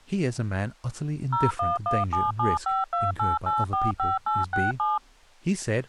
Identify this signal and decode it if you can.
DTMF, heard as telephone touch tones, dialled by machine, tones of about 180 ms, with speech in English. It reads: 01177528845867